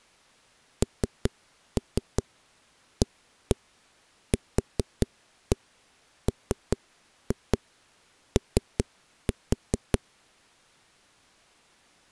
Tap code, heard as knocks on a wall, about 5 knocks a second. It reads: NAQMO